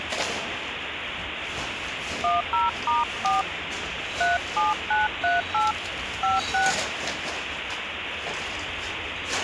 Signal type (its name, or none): DTMF